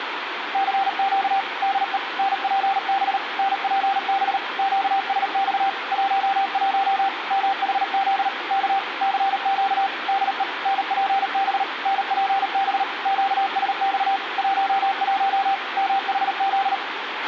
Morse code, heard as a keyed tone, machine-sent, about 38 wpm, 780 Hz, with radio hiss, a squelch burst at the end and room echo. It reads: CQ DE NPB NPB QSX 11 MHZ K CQ DE NPB NPB QSX 11 MHZ